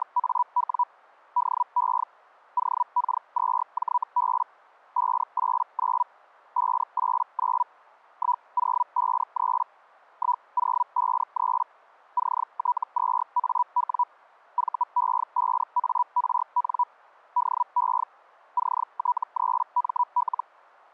Hellschreiber (Feld-Hell, 122.5 baud), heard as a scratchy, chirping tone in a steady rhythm, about 980 Hz. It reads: … DE OK2JB 589 589 1053 1053 CT2AW VE5ARN DE CT3ML